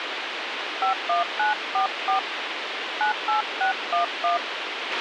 DTMF, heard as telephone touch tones, dialled by hand, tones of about 120 ms, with radio hiss and a squelch burst at the end. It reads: 51944 98611